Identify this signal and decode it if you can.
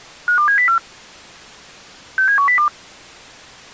Five-tone selective call (CCIR), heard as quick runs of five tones, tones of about 100 ms. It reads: 52704 67102